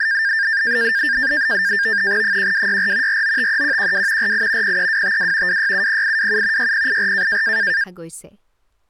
NAVTEX (SITOR-B), 100 baud, 170 Hz shift, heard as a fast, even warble, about 1700 Hz centre, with speech in Assamese. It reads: 1264 4953112 48 03252 2670827 6084